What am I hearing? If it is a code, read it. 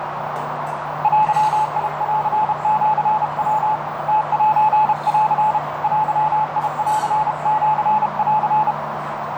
Morse code (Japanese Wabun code), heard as a keyed tone, hand-sent with a paddle, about 32 wpm, 860 Hz, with heavy radio static, a narrow filter and the noise of a cafe. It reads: デンシヤ ムセン デンシン